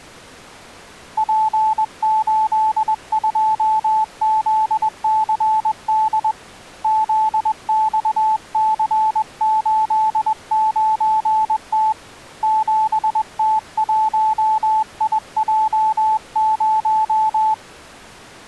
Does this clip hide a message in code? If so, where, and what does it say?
Yes: Morse code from 1.1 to 17.6 s, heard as a keyed tone, hand-sent with a paddle, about 21 wpm, 870 Hz. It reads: P82ZCD ZXC89T 7T1IJ0